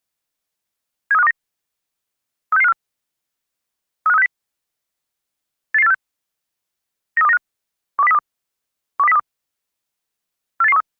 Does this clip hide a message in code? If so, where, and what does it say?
Yes: five-tone selective call (EEA) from 1.1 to 10.8 s, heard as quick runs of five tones, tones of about 40 ms. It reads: 73529 36654 35360 88846 93295 12032 12032 48813